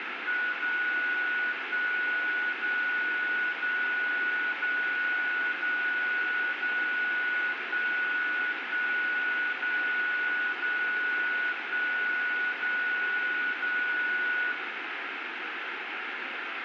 Radio time signal (DCF77), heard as a tone whose level steps once a second, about 1470 Hz, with radio static and room echo. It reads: 0 1 0 0 0 0 0 1 1 0 0 1 0 0